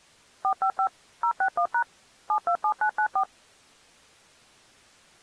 DTMF, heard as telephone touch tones, dialled by machine, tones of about 80 ms. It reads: 455 061# 727994